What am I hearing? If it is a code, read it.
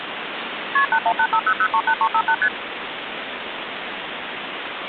Multi-frequency trunk signalling (R1, as on North American trunks), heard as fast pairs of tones, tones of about 70 ms, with phone line noise. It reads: KP 81850038358 ST